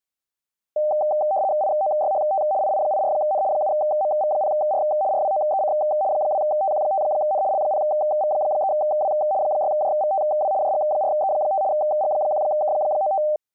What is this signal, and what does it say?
RTTY (75 baud, 170 Hz shift), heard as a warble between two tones, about 690 Hz centre. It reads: IOYHT II84N 7MV0R RWOEC 2TQ5N L0V3W 6JVTW JG4E5 G1K95